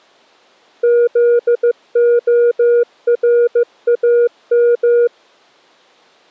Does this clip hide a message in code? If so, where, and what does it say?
Yes: Morse code (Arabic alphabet) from 0.8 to 5.1 s, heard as a keyed tone, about 15 wpm, 480 Hz. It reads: ذخرام